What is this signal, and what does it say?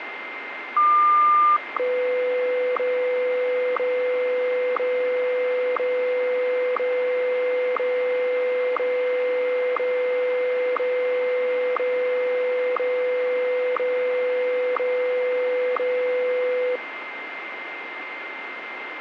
Radio time signal (WWVH, Hawaii), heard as ticks, one a second, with radio static and a steady whistle near 2090 Hz.